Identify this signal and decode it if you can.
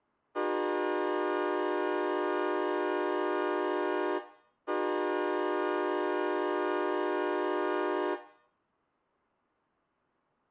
Train horn signal, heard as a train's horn, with room echo. 2 long. On North American railways: brakes released, proceed.